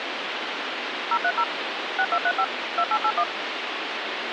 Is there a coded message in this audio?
Yes: DTMF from 1.1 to 3.2 s, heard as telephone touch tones, dialled by machine, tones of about 60 ms, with phone line noise. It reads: 030 6235 2881